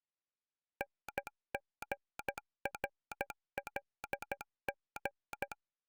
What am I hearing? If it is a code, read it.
Morse code, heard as a telegraph sounder, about 13 wpm. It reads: NGRLG